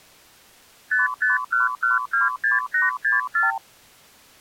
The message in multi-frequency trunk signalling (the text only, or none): 551126864